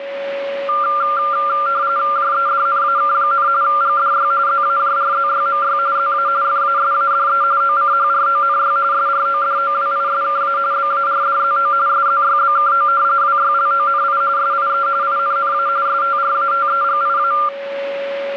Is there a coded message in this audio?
Yes: RTTY (45.45 baud, 170 Hz shift) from 0.7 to 17.5 s, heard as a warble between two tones, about 1280 Hz centre, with a steady whistle near 560 Hz. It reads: JEDNAK, GDY ZAJRZYMY ZA FASADE OCHRONY SRODOWISKA BARDZO SZYBKO WYLONI SIE INNA STRATEGIA